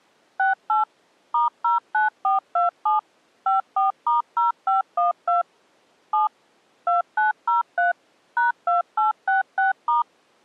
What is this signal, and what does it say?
DTMF, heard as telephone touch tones, dialled by machine, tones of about 140 ms. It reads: 68 *09427 54*0512 7 2903 #2866*